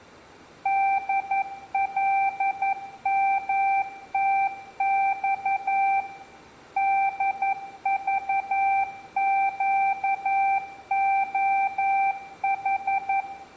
Morse code, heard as a keyed tone, machine-sent, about 11 wpm, 780 Hz, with room echo. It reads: DLMTX DVQOH